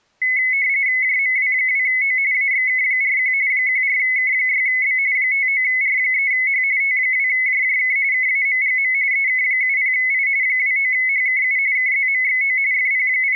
RTTY (45.45 baud, 170 Hz shift), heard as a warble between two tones, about 2100 Hz centre. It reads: JMW2O AXK41 14K6B 59R3H T2JJK KAMGM EK70I 29HKU KZMXO …